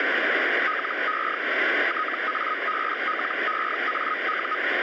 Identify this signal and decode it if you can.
Hellschreiber (Feld-Hell, 122.5 baud), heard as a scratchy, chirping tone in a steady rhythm, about 1260 Hz, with radio static. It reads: LE TABLEAU